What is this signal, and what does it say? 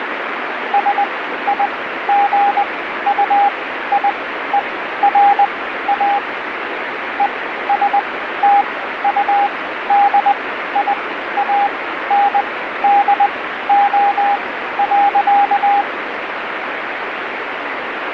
Morse code, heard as a keyed tone, machine-sent, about 20 wpm, spaced as for 13 wpm, 810 Hz, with radio static. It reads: SIGUIERA ESTUDIANDO.